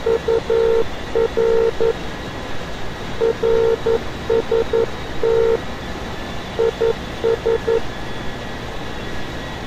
Morse code, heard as a keyed tone, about 11 wpm, 460 Hz, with radio static and street noise. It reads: UR RST IS